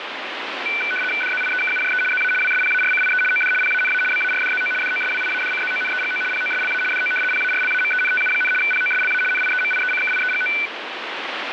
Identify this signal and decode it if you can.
RTTY (75 baud, 850 Hz shift), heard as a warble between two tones, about 1900 Hz centre, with radio static. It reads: DZIEKUJE ZA WSPARCIE OD PANA BARDZO DOSWIADCZONEGO POSLA DO PARLAMENTU, POSLA NIEMIECKIEGO